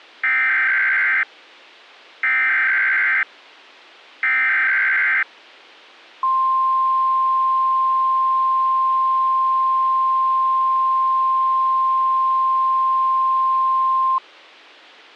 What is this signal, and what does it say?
Emergency Alert System (SAME) tones (header bursts, then the 1050 Hz attention tone), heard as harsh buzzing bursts, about 520.83 baud.